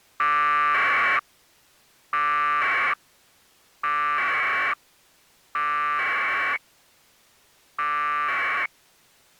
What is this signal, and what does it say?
Packet radio (AX.25, as in APRS), 1200 baud, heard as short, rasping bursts.